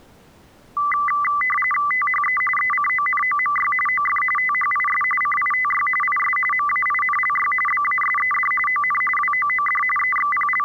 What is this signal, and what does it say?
RTTY (45.45 baud, 850 Hz shift), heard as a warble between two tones, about 1600 Hz centre. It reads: THE ECONOMY OF THIS CITY IS MAINLY BASED ON WOOD …